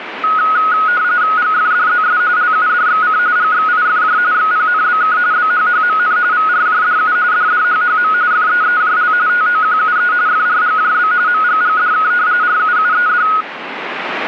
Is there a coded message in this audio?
Yes: RTTY (45.45 baud, 170 Hz shift) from 0.2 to 13.4 s, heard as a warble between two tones, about 1360 Hz centre, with radio static. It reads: GFDZS LUDXC GXIFJ XPNBK BHHMN VRJDU DDHHM FEEJL TOQUE FRGJB MGGDK RUUED